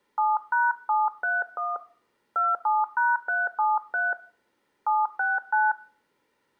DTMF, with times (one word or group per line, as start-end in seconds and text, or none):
0.2-1.8 7#731
2.4-4.1 27#373
4.9-5.7 769